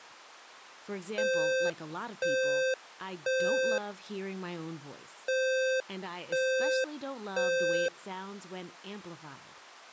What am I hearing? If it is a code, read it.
Alarm pattern, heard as an alarm's beeps, played twice, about 520 Hz, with speech in English. Temporal three. Smoke or fire, evacuate.